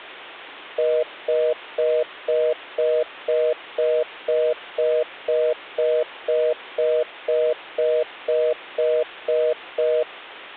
Telephone call progress tone (North American plan), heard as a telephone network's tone, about 480, 620 Hz, 0.25 s on and 0.25 s off. Congestion tone.